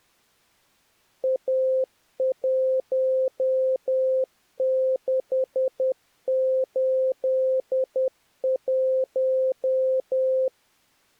Morse code, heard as a keyed tone, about 10 wpm, 520 Hz. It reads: A1681